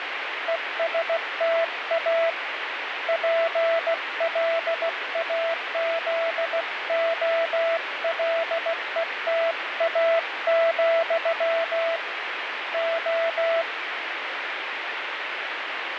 Morse code, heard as a keyed tone, hand-sent with a paddle, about 16 wpm, 660 Hz, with radio static. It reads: ESTA PLAZOLETA, O